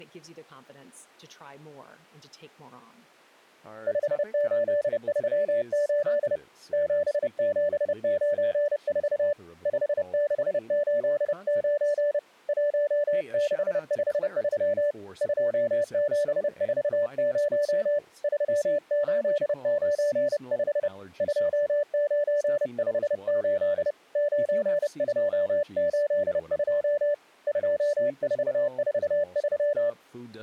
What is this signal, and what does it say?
Morse code, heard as a keyed tone, hand-sent with a paddle, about 30 wpm, 580 Hz, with speech in English. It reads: 5838 7794 5689 1653 2740 3895 2958 9282 2443